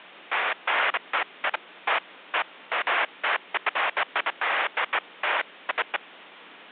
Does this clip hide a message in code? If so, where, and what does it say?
No, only bursts of noise, with phone line noise.